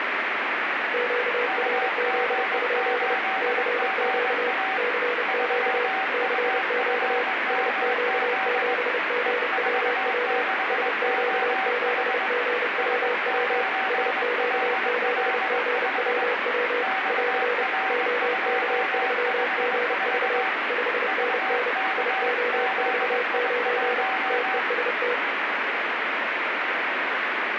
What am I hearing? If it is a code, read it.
Morse code, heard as two keyed tones, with heavy radio static. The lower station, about 30 wpm, 490 Hz: QRZ? CQ CQ CQ SQ7GWW SQ7GWW SQ7GWW <AR> OK3GV 5NN IO49 TEST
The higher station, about 21 wpm, 760 Hz: UG8GA 3UFMZ E46OH S9LL5 XR254 VKZI1